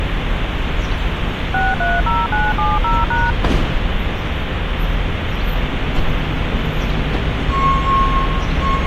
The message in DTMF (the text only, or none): 630970#